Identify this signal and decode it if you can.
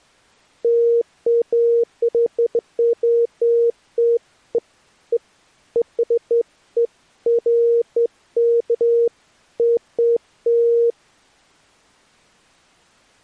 Beeps of irregular length. There is no code.